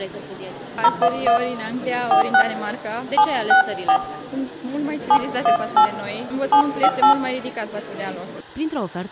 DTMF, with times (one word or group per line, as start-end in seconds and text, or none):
0.8-1.4 011
2.1-2.4 46
3.2-4.0 764
5.1-5.9 718
6.5-7.1 758